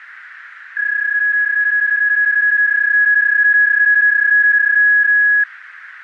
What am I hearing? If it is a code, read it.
PSK31 (31.25 baud), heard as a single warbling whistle, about 1650 Hz, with radio static and a narrow filter.